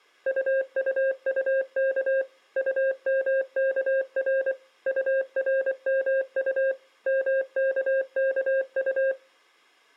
Morse code, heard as a keyed tone, machine-sent, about 24 wpm, 540 Hz. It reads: UUUK UMKR URMU MKKU